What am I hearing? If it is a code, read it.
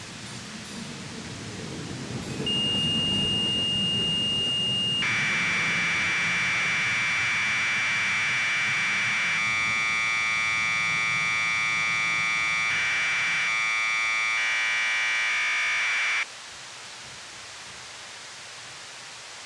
Commodore tape loading (standard loader), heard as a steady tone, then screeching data, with tape hiss.